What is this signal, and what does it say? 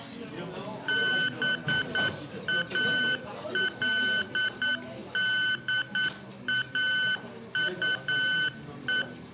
Morse code, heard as electronic beeps, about 9 wpm, 1500 Hz, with room echo and the noise of a restaurant. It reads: BALDAUE